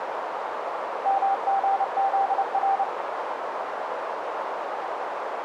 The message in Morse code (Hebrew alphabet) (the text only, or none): מגזר